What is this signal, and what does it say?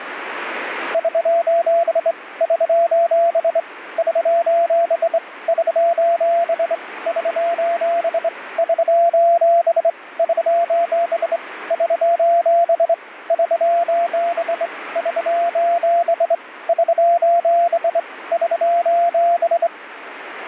Morse code, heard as a keyed tone, hand-sent with a straight key, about 25 wpm, 680 Hz, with radio static. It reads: <SOS> <SOS> <SOS> <SOS> <SOS> <SOS> <SOS> <SOS> <SOS> <SOS> <SOS> <SOS>